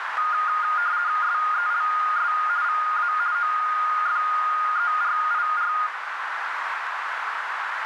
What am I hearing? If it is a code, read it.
RTTY (50 baud, 170 Hz shift), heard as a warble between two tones, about 1330 Hz centre, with radio static and a narrow filter. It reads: SELS VA OFERIR